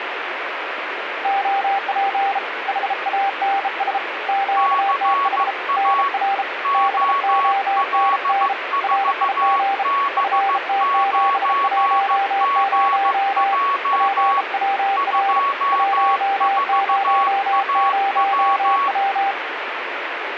Morse code, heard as two keyed tones, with radio static. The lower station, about 33 wpm, 790 Hz: OP HANS QTH NR BONN RIG FT710 PWR 100W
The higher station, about 15 wpm, 1120 Hz: CA OL4B9GJ 24AW